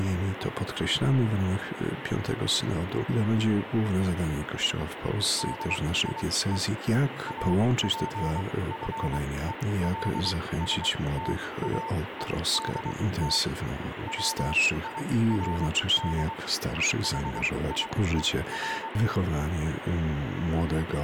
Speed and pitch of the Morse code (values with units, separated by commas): 23 wpm, spaced as for 17 wpm, 900 Hz